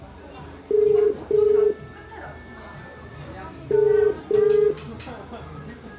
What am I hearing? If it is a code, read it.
Telephone call progress tone (as in the UK, Ireland, Australia and similar networks), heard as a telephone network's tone, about 430 Hz, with room echo and the noise of a cafe. Ringback tone.